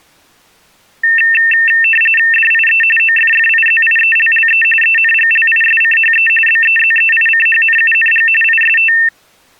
RTTY (45.45 baud, 850 Hz shift), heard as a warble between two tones, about 2250 Hz centre. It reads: DIE OFFIZIELLE ENGLISCHE BEZEICHNUNG IST